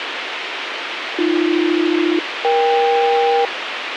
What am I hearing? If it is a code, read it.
Aircraft SELCAL, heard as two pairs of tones, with radio hiss. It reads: AB-EK